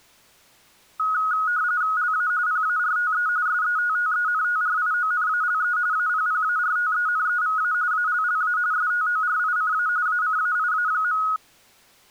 RTTY (45.45 baud, 170 Hz shift), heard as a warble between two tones, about 1360 Hz centre. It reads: LA PARTE SETTENTRIONALE APPARTENEVA ALLA STORICA ACAIA.